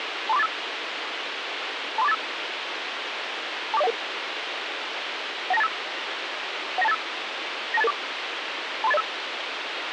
Five-tone selective call (EIA), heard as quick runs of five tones, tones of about 30 ms, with radio hiss. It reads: 23485 23485 24011 19285 19285 92884 23805